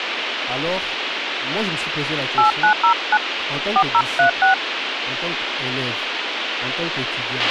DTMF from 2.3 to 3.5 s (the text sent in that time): 8909